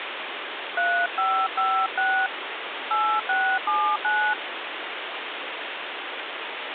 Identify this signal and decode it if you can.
DTMF, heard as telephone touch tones, dialled by hand, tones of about 290 ms, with phone line noise. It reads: 3556 8679